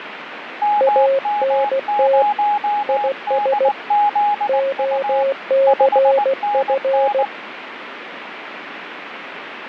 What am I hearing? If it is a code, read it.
Morse code, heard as two keyed tones, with radio static and fading. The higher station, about 19 wpm, 830 Hz: MM0DZU 5NN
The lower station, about 16 wpm, 540 Hz: ANT IS OCF